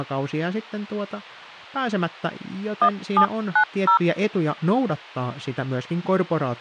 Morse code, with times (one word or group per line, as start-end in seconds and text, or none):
none